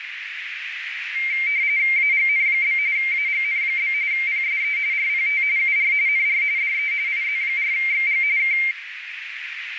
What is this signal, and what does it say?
RTTY (45.45 baud, 170 Hz shift), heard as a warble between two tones, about 2200 Hz centre, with radio static and a narrow filter. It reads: AGN? AGN? PSE RPT UR NR DE IZ4XG K